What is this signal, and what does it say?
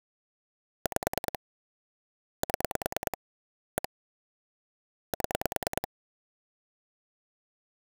Pulse dialling, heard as clicks on a phone line, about 9 pulses a second. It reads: 5 7 1 7